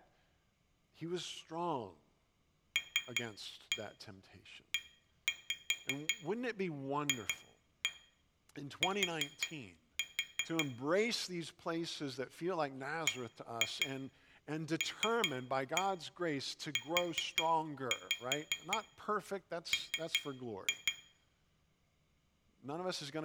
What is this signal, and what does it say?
Tap code, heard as taps on glass, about 5 knocks a second, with room echo and speech in English. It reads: LEFT BLUM